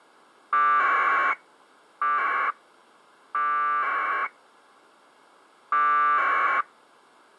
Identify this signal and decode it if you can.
Packet radio (AX.25, as in APRS), 1200 baud, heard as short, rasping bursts.